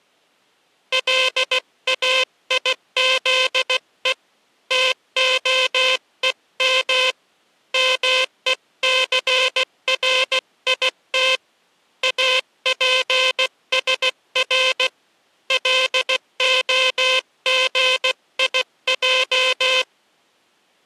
Morse code (Hebrew alphabet), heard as a buzzer, hand-sent with a paddle, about 16 wpm. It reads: לאיזו תהום מוסרית אפשר להגיע